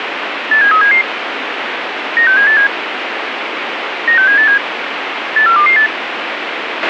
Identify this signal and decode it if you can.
Five-tone selective call (CCIR), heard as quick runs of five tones, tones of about 100 ms, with radio hiss and a squelch burst at the end. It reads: 87377 96787 96787 84228